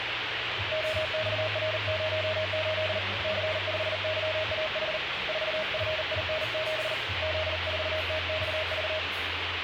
Morse code, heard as a keyed tone, hand-sent with a paddle, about 39 wpm, 630 Hz, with radio static and the noise of a cafe. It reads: OXR08 C5YAH 4FIN7 Z4TXV